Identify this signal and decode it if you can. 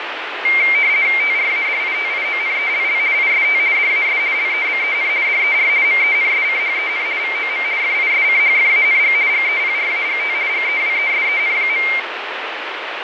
RTTY (50 baud, 170 Hz shift), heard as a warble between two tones, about 2200 Hz centre, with radio static and fading. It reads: TRADITIONELL IST DAS LEBEN DER MENSCHEN VOM FISCHFANG GEPRAGT GEWESEN.